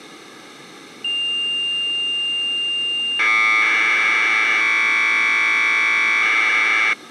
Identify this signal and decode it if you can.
Commodore tape loading (standard loader), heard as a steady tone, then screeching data.